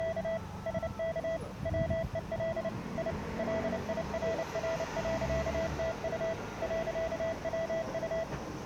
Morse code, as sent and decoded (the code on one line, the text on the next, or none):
… / ... -.- / .-- . .-.. / .. / .-.. .. .-. .-. .-.-.- - ..- / .-.-.- .-- ..-
… SK WEL I LIRR.TU .WU